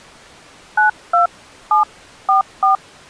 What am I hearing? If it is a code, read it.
DTMF, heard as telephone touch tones, dialled by hand, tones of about 130 ms. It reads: 92744